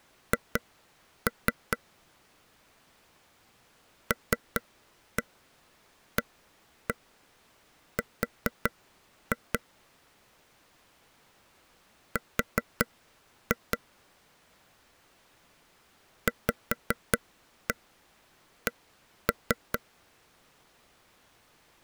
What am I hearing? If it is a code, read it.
Tap code, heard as taps on a table, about 5 knocks a second. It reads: H LAR R VC